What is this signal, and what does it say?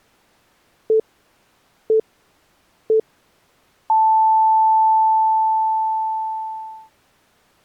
Radio time signal (three low pips and a long one an octave up, as on NHK), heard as pips.